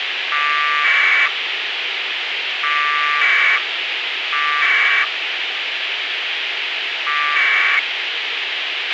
Packet radio (AX.25, as in APRS), 1200 baud, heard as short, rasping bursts, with radio hiss and a squelch burst at the end.